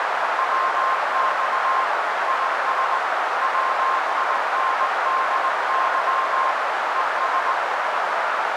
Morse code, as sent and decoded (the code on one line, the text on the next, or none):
.-- -..- / .. ... / .-- .. -. -.. -.-- / . ...
WX IS WINDY ES